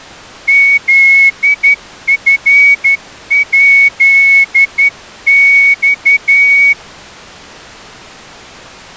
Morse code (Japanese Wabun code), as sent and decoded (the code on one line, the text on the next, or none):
--.. ..-. .--.. -..-
フチヱマ